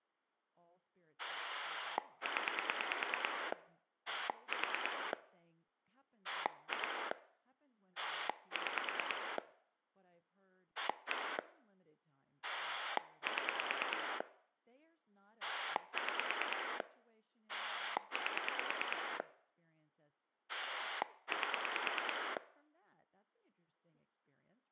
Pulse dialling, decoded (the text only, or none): 0 4 2 6 1 7 6 8 8